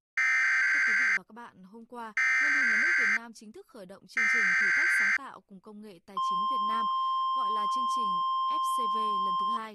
Emergency Alert System (SAME) tones (header bursts, then the 1050 Hz attention tone), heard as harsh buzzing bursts, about 520.83 baud, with speech in Vietnamese.